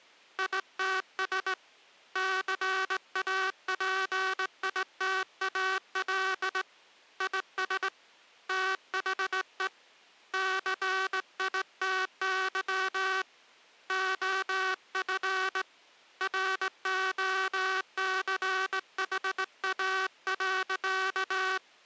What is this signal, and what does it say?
Morse code, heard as a buzzer, hand-sent with a straight key, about 18 wpm. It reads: ITS CAPITAL IS THE CITY OF ROCHA.